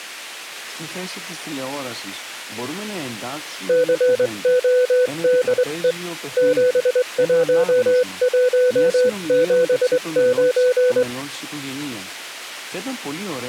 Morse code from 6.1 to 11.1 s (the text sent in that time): 71179